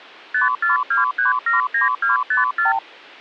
Multi-frequency trunk signalling (R2, with the far end's replies), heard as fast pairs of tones, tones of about 140 ms. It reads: 542379254